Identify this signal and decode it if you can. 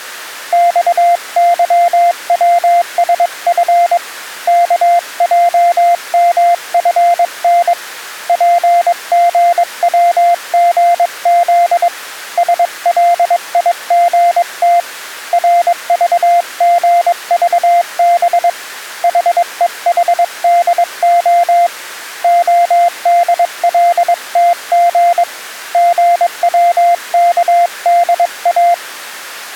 Morse code, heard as a keyed tone, hand-sent with a paddle, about 22 wpm, 700 Hz. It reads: XYWSF KJMFN PGWGZ SLIGT RVGVB HEHDO ODLTG GWKDA